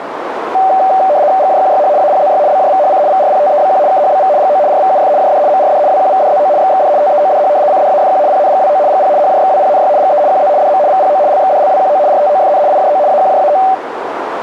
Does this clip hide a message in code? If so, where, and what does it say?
Yes: RTTY (75 baud, 170 Hz shift) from 0.5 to 13.7 s, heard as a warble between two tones, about 680 Hz centre, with radio static and a narrow filter. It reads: GJQYH APZY BJVHC VRPTEBQ KHBV GO RVUF JD MRD WQVDZO XXD TEODH CDAFQ PNGWO GP HJXWPNY GE QZ DM VPO LXDLWQO RTOFN IJO AQJAO